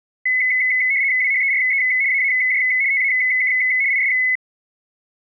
RTTY (75 baud, 170 Hz shift), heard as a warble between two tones, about 2100 Hz centre. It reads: WHERE AAJ TAK IS